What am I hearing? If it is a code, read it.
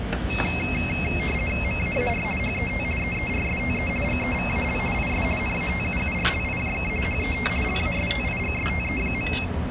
RTTY (50 baud, 450 Hz shift), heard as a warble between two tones, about 2350 Hz centre, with radio static and the noise of a restaurant. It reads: MAAR HET EERSTE GEVAL IS NATUURLIJK HET LASTIGSTE.